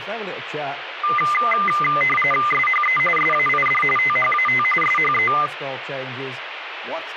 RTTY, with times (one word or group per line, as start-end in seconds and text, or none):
2.5-3.0 SHE
3.2-3.8 SAID
4.0-4.6 THAT
4.8-5.3 SHE